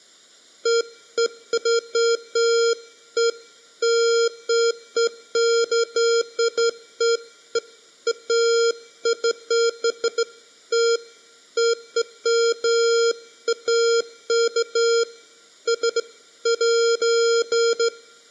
Beeps of irregular length. There is no code.